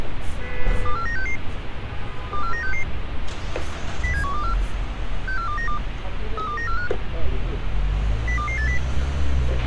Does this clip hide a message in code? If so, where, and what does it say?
Yes: five-tone selective call (CCIR) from 0.9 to 8.8 s, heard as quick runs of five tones, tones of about 100 ms, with radio hiss, a squelch burst at the end and street noise. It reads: 24966 24966 07124 64292 32945 02280